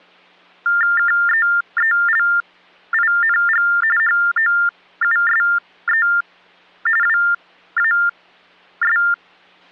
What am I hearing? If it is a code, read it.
TTY/TDD text telephone tones (45.45 baud Baudot), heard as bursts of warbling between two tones, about 400 Hz shift, 1600 Hz centre. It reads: KEELING HOUSE WAS